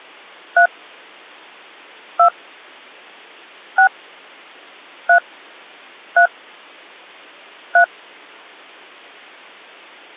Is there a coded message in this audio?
Yes: DTMF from 0.6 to 7.8 s, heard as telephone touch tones, dialled by hand, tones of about 90 ms. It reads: 3 2 6 3 3 3